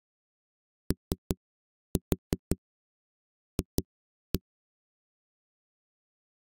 Tap code, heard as knocks on a wall, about 5 knocks a second. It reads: OF